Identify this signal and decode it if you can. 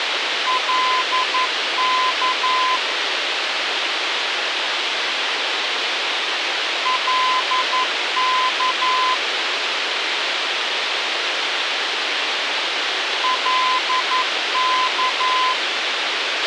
Morse code, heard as a keyed tone, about 11 wpm, 1020 Hz, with radio hiss and a squelch burst at the end. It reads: LK LK LK